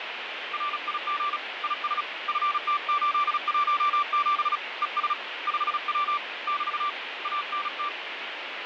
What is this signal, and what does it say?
Morse code, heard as a keyed tone, hand-sent with a paddle, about 36 wpm, 1170 Hz, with radio static. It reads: RIG IS FT817 ES 5W <BT> ANT